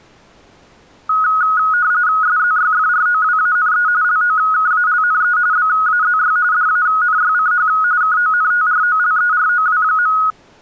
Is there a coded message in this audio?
Yes: RTTY (45.45 baud, 170 Hz shift) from 1.1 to 10.3 s, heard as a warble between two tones, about 1360 Hz centre. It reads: SZYFROWANE LOKALNE BAZY DANYCH KONTROLEROW.